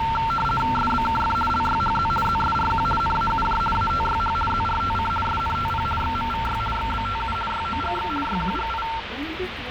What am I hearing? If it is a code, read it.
RTTY (50 baud, 450 Hz shift), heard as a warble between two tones, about 1130 Hz centre, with radio static and the noise inside a bus. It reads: SBKF LYHZ ZSRQ NAUJ ATYH ZRTC SNTP XMVY XBTU YOGX YQGI